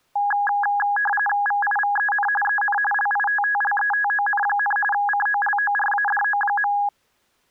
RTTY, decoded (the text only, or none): VIVEN EN LITTLETON, COLORADO.